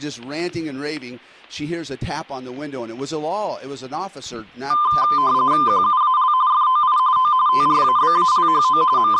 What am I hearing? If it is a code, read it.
RTTY (45.45 baud, 170 Hz shift), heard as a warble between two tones, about 1110 Hz centre, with static crashes. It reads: QUAL FOI O TRABALHO …